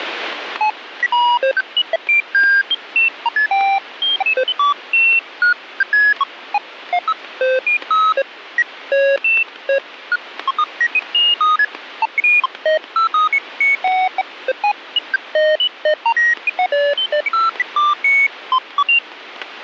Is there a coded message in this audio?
No, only electronic bleeps of random pitch and length, with radio static and static crashes.